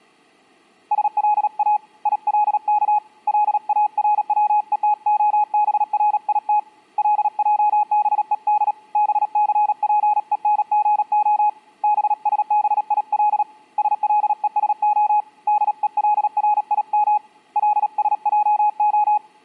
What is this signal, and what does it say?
Morse code (Hebrew alphabet), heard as a keyed tone, hand-sent with a paddle, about 37 wpm, 840 Hz. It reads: שלא ילך לארצותהברית לעבוד בספונגה בשביל שלושה דולרים לשעה